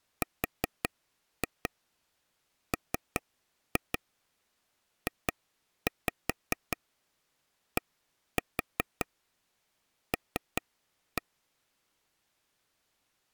Tap code, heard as taps on a table, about 5 knocks a second. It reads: RMJDL